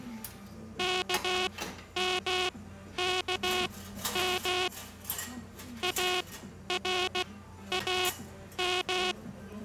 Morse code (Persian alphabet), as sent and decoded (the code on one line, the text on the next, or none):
-.- -- -.- -- / .- .-. .- --
کمکم ارام